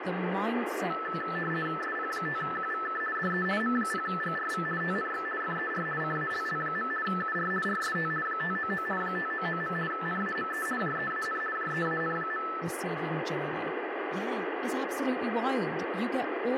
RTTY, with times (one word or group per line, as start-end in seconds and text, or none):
1.8-3.0 SP5QVK
3.1-3.4 DE
3.6-4.6 M0GRV
4.8-5.2 TNX
5.4-5.8 FER
6.0-6.9 CALL.
7.0-7.5 UR
7.6-8.1 RST
8.2-8.8 599
9.0-9.7 599.
9.9-10.6 NAME
10.8-11.4 JEAN
11.5-12.4 JEAN.